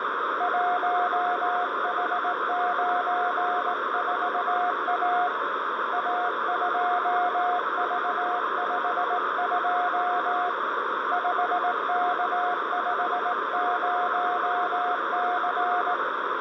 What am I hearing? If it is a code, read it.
Morse code, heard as a keyed tone, hand-sent with a straight key, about 18 wpm, 720 Hz, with radio static, a narrow filter and room echo. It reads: 1H94A A2V52 5K50C